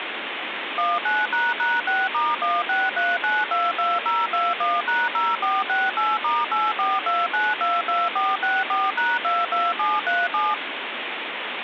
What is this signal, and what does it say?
DTMF, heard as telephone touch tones, dialled by machine, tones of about 200 ms, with phone line noise. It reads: 19##6*163922021#0468*842922464#22737